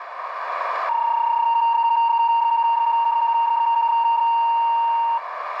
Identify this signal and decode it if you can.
PSK31 (31.25 baud), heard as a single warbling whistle, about 930 Hz, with radio static and a narrow filter.